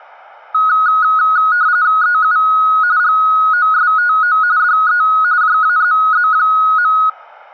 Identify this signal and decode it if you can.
RTTY (45.45 baud, 170 Hz shift), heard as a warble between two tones, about 1360 Hz centre. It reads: EU GOSTO DE JAZZ.